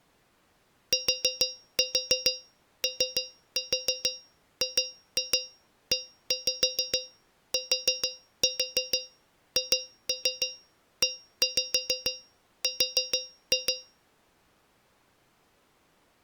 Tap code, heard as taps on a metal pipe, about 6 knocks a second. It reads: TOGETHER